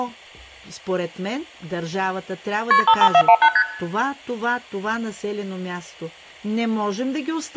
Multi-frequency trunk signalling (R1, as on North American trunks), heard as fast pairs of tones, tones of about 70 ms, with room echo and speech in Bulgarian. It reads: KP 55418 ST